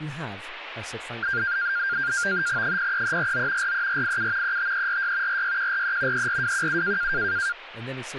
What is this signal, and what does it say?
NAVTEX (SITOR-B), 100 baud, 170 Hz shift, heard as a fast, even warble, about 1500 Hz centre, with speech in English. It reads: 03349 43487 35346 46143 34217